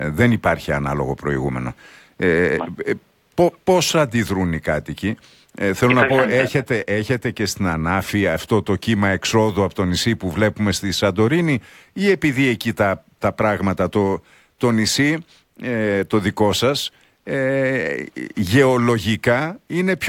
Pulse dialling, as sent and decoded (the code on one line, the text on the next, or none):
none